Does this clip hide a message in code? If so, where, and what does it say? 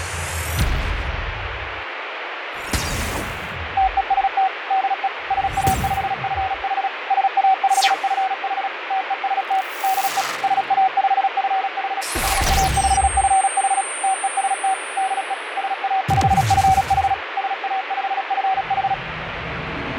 Yes: Morse code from 3.7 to 19.0 s, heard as a keyed tone, machine-sent, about 36 wpm, 760 Hz, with radio static and fading. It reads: TEST DE SA5FH SA5FH TEST DE SA5FH SA5FH TEST DE SA5FH SA5FH